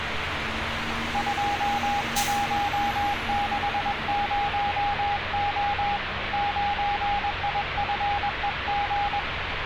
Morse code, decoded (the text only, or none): 2160O 9IFEG